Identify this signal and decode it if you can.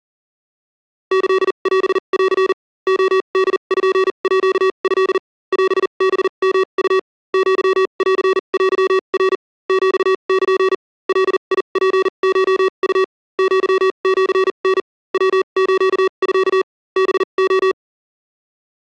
Morse code (Japanese Wabun code), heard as electronic beeps, machine-sent, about 40 wpm, spaced as for 32 wpm, 380 Hz. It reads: キオン レポート オハヨウ アンテナ ヒル ガツコウ アシタ ヤスミ ハレ